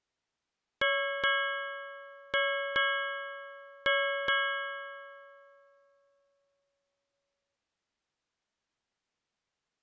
Ship's bell, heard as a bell. 6. Six half-hours of the watch have passed.